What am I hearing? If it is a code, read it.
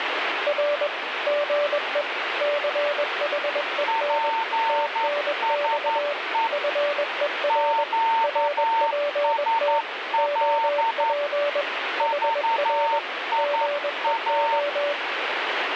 Morse code, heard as two keyed tones, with radio static. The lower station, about 21 wpm, 580 Hz: R GE CHEN TNX FER RPT OP HR GEO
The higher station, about 11 wpm, 910 Hz: PSE QSL VIA